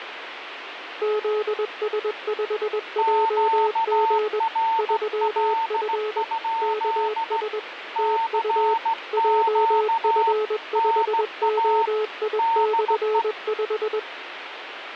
Morse code, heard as two keyed tones, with radio static. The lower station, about 21 wpm, 430 Hz: ZS5JG 3F KS TU JF5OI/5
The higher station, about 16 wpm, 910 Hz: QRL? CQ NA DE